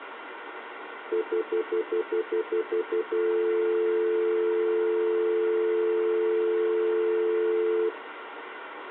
Telephone call progress tone (North American plan), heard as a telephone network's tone, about 350, 440 Hz, 0.1 s on and 0.1 s off, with phone line noise. Stutter dial tone.